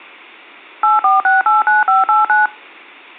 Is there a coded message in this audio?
Yes: DTMF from 0.8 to 2.5 s, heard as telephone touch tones, dialled by machine, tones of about 160 ms. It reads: 84689589